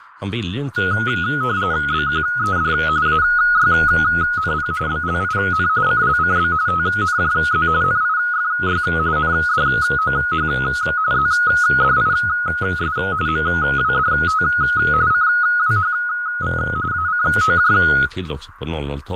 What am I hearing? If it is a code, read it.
RTTY (45.45 baud, 170 Hz shift), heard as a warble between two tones, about 1360 Hz centre, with radio static, fading and speech in Swedish. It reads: BQED AYNP BLIN CLCB TNJZ NIFY NDOH ZDIS MWDT CWHV ACOJ